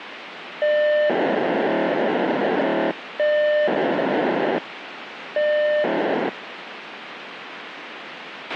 POCSAG pager data (1200 baud), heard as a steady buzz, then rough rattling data, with radio hiss and a squelch burst at the end.